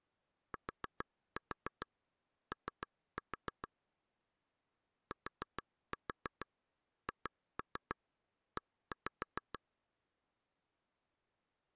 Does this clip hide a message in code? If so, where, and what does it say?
Yes: tap code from 0.5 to 9.6 s, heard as taps on a table, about 6 knocks a second. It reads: TO THE